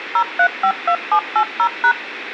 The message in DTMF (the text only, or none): 0352780#